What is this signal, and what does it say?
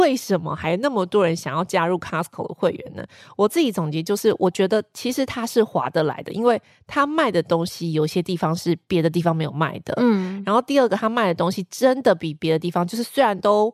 Speech in Chinese. There is no code.